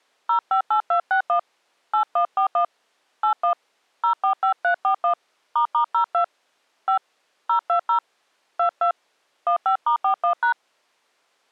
DTMF, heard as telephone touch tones, dialled by hand, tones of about 100 ms. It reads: 058261 8141 81 045341 **02 5 020 22 15*41#